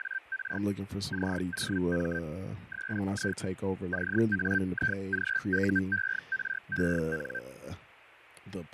Hellschreiber (Feld-Hell, 122.5 baud), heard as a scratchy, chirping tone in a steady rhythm, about 1550 Hz, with radio static, fading and speech in English. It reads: … COM SI CAIGUEREN